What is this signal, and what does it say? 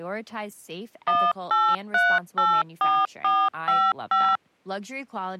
DTMF, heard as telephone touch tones, dialled by machine, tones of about 240 ms, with speech in English. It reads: 18384455